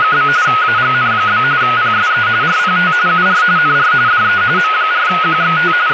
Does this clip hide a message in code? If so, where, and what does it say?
Yes: RTTY (45.45 baud, 170 Hz shift) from 0.0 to 5.9 s, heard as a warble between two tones, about 1360 Hz centre, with radio static and speech in Persian. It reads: … AGN? PSE RPT UR NR DE M4QXT …